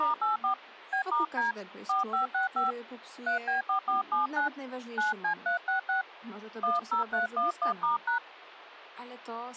DTMF, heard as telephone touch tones, dialled by hand, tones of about 130 ms, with speech in Polish. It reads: *84 B*D 4565 3B4479 9C366 10311*#